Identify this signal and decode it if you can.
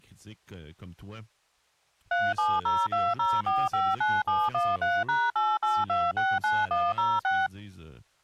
DTMF, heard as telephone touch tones, dialled by machine, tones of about 220 ms, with speech in French. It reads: 37020459713#88269106